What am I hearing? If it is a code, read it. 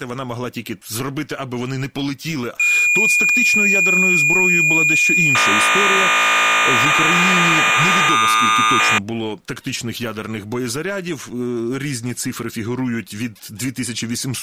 Cassette data (Kansas City type), 1200 baud, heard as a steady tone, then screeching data.